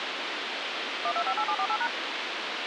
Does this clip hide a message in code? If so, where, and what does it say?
Yes: DTMF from 1.0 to 1.9 s, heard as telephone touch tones, dialled by machine, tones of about 70 ms, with radio hiss. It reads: 1258748#